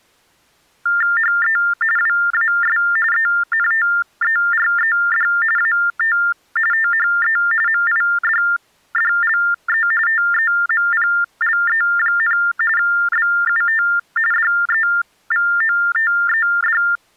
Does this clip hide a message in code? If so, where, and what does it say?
Yes: TTY/TDD text telephone tones (45.45 baud Baudot) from 0.9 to 17.0 s, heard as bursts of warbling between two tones, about 400 Hz shift, 1600 Hz centre. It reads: HE WAS ENTERED AT THE MIDDLE TEMPLE, BUT DEVOTED